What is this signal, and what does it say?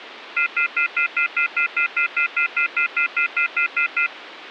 Telephone call progress tone (North American plan), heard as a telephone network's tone, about 1400, 2050, 2450, 2600 Hz, 0.1 s on and 0.1 s off, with phone line noise. Off-hook warning tone.